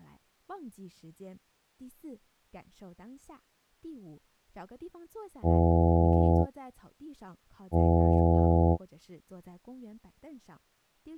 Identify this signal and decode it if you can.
Ship horn signal, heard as a ship's horn, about 80 Hz, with speech in Chinese. 2 short. At sea: I am altering course to port.